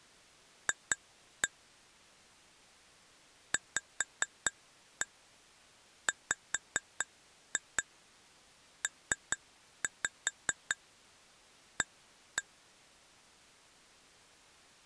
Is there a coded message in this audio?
Yes: tap code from 0.7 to 12.4 s, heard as taps on glass, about 4 knocks a second. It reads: F VWPA